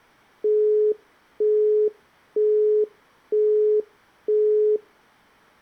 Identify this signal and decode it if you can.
Telephone call progress tone (single-tone plan, as in Europe, Japan and elsewhere), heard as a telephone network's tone, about 420 Hz, 0.48 s on and 0.48 s off. Busy tone.